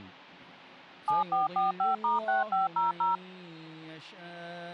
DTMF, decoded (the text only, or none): 7445*6500